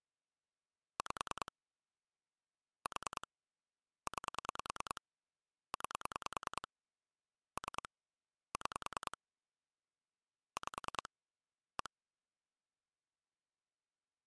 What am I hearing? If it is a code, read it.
Pulse dialling, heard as clicks on a phone line, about 10 pulses a second. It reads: 5 4 9 9 3 6 5 1